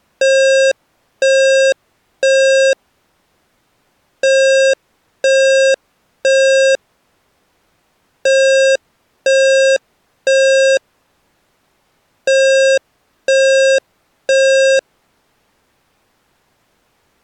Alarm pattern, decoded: temporal three

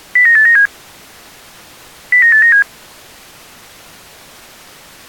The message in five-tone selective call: 09897 09897

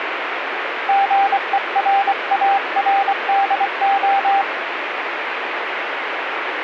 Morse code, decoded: GERARDO

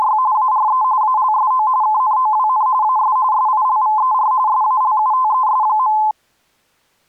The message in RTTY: … ARE ALSO KNOWN AS SILVER SALUTES.

